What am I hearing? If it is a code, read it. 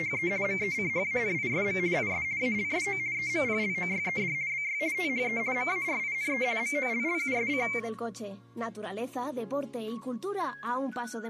RTTY (50 baud, 170 Hz shift), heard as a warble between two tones, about 2200 Hz centre. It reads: … MECHANISM IS ALSO EMPLOYED BY THE MARINE MOLLUSC